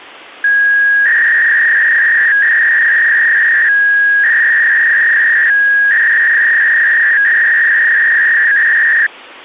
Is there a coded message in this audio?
Yes: 300-baud modem data (V.21 tones) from 0.4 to 9.1 s, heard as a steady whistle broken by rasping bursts, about 300 baud, 200 Hz shift.